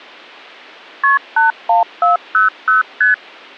Multi-frequency trunk signalling (R1, as on North American trunks), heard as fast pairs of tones, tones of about 140 ms. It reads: KP 81400 ST